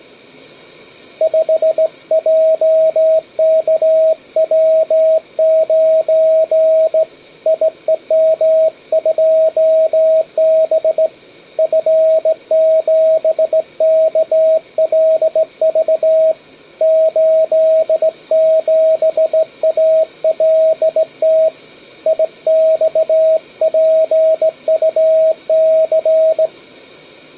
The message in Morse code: 5JKW9 IEM2B F7KLV 87ALT IXPUC

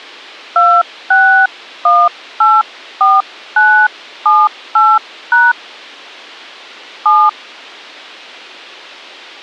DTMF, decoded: 26184978# 7

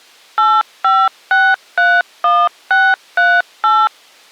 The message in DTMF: 85631638

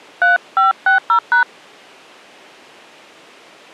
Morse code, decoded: none

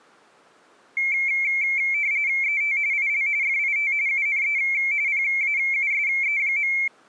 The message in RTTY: ET IL FIT UNE PAUSE.

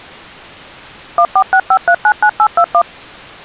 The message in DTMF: 1465399821

